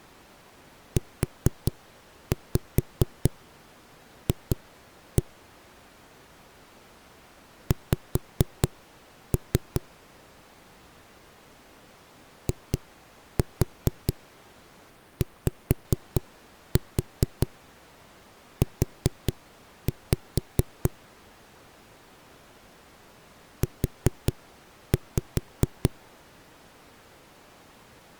Tap code, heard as knocks on a wall, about 4 knocks a second. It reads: UF X IYU U